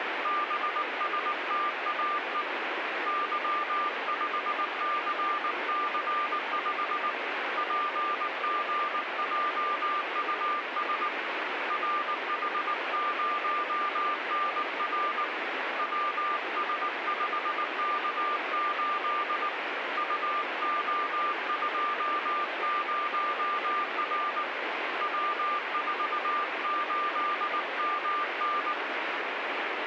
Morse code, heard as a keyed tone, hand-sent with a paddle, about 19 wpm, 1190 Hz, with radio static. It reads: BSTAE Y5CC5 PGJUS RH0NR WS5K8 UO20R W48MN